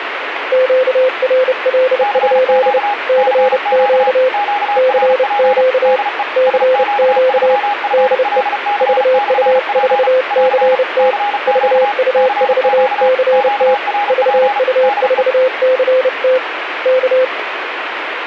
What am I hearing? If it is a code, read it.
Morse code, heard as two keyed tones, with radio static. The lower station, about 30 wpm, 520 Hz: QRL? CQ CQ CQ DE VU4CT VU4CT VU4CT K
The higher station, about 35 wpm, 820 Hz: CQ CQ QRP DE SQ3FLC/P <AR> CQ CQ QRP DE